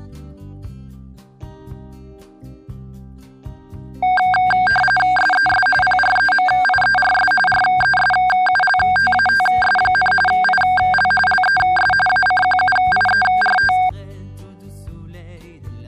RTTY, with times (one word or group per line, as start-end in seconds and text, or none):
5.2-5.7 SES
5.8-7.3 PREMIERS
7.5-10.1 RESULTATS,
10.3-11.1 IL
11.3-11.9 LES
12.1-13.7 ACQUIERT